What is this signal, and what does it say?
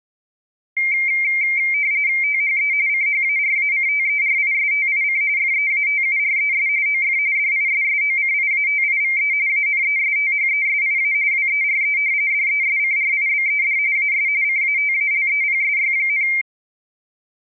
RTTY (45.45 baud, 170 Hz shift), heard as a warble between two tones, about 2200 Hz centre. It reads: THE CHARACTERISTIC FEATURES OF DISSOCIATIVE ANESTHESIA WERE DESCRIBED AS CATALEPSY,